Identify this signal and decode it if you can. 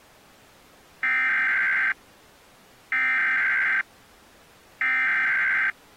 Emergency Alert System (SAME) tones (header bursts), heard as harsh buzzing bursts, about 520.83 baud.